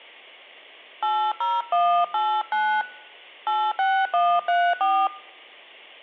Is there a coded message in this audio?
Yes: DTMF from 1.0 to 5.1 s, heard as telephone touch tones, dialled by hand, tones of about 260 ms. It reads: 80189 86134